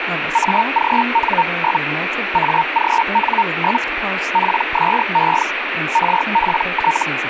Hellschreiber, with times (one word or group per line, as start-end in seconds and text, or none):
0.3-1.8 AGN?
2.3-3.8 AGN?
4.3-5.4 PSE
5.9-7.0 RPT